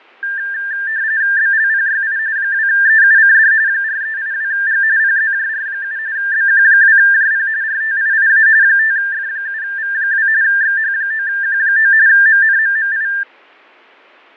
RTTY (45.45 baud, 170 Hz shift), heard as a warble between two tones, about 1700 Hz centre, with fading. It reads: BLPYI 2EUCD 4382G PZJR7 BQ2JP RTIIA 5F7V2 XH9Q9 MNMMI